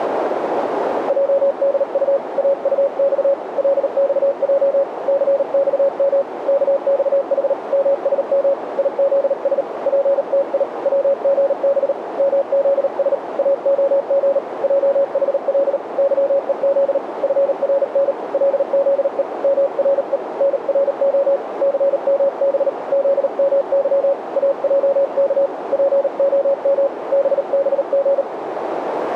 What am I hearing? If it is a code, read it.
Morse code, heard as a keyed tone, hand-sent with a paddle, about 38 wpm, 560 Hz, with radio static and a narrow filter. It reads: JDU AUX LXJ CXM KXH MSM IZS PTI WGB MZS AOG JHL YEZ FRN LZE MRE NRO CMB ZMY AJK POM BBG